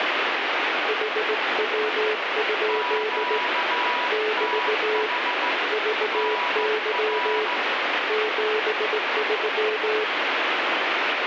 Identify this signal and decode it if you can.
Morse code, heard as two keyed tones, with heavy radio static. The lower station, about 18 wpm, 430 Hz: HW? <BT> VY 73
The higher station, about 15 wpm, 980 Hz: QTH NR